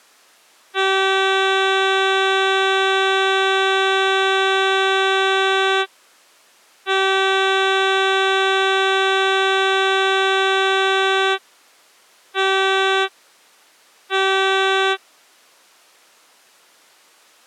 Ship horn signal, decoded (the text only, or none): 2 long, 2 short